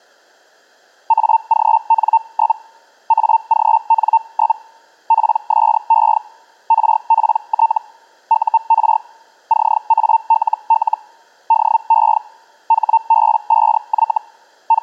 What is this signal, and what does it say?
Hellschreiber (Feld-Hell, 122.5 baud), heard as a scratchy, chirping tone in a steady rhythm, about 900 Hz. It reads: AGN? AGN? PSE RPT UR CALL DE HB5Y …